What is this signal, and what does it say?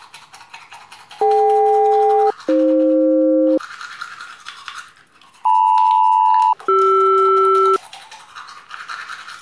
Aircraft SELCAL, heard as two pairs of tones, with the noise of a restroom. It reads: DK-AF LM-CR